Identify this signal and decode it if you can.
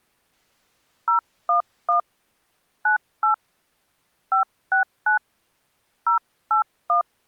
DTMF, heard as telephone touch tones, dialled by hand, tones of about 110 ms. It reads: 011 98 569 081